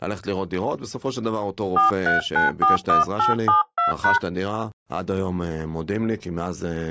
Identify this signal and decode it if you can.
DTMF, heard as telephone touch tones, dialled by hand, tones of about 140 ms, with speech in Hebrew. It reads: 43941872#